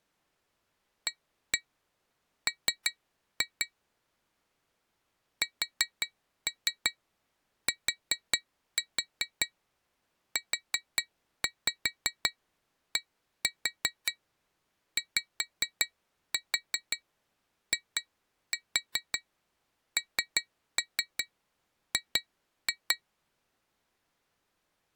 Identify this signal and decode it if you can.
Tap code, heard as taps on glass, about 5 knocks a second. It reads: AM STUDYING